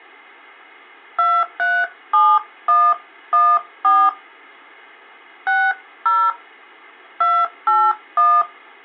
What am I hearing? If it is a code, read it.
DTMF, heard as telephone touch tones, dialled by hand, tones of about 240 ms. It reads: 237114 60 281